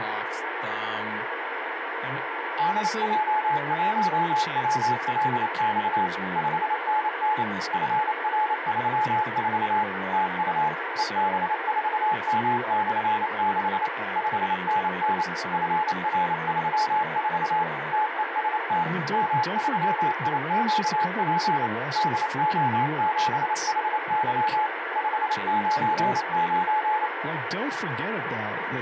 Morse code, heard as a keyed tone, machine-sent, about 28 wpm, 860 Hz, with radio static and speech in English. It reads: DJ1WLX 5NN FR34 TU EB4M/6 5NN FR34 TEST M3IQP DO7HY 599